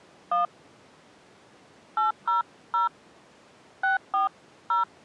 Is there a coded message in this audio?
Yes: DTMF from 0.3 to 4.8 s, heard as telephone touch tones, dialled by hand, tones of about 140 ms. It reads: 1 800 640